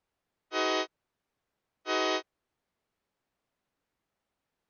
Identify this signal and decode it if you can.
Train horn signal, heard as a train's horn. 2 short. On North American railways: a signal is acknowledged.